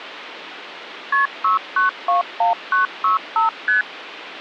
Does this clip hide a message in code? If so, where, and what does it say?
Yes: multi-frequency trunk signalling (R1, as on North American trunks) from 1.1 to 3.8 s, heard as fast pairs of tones, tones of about 130 ms, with phone line noise. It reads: KP 6921965 ST